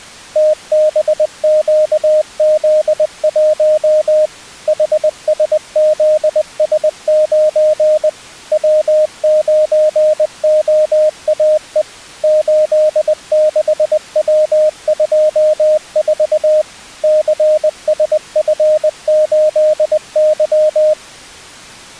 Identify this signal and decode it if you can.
Morse code, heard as a keyed tone, machine-sent, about 20 wpm, 620 Hz. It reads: TBQZ1 HSZS9 W9OAE 86W24 CSF8Y